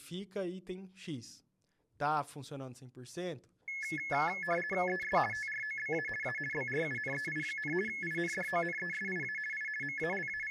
RTTY (50 baud, 450 Hz shift), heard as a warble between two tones, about 1950 Hz centre, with speech in Portuguese. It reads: ES TROBA A BRUNEI, INDONESIA I …